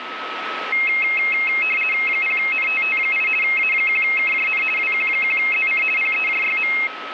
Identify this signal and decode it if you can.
RTTY (50 baud, 450 Hz shift), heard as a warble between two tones, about 2350 Hz centre, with radio static and a steady whistle near 1290 Hz. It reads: 0NTT8 A1KJN WQ1ZC PEJYM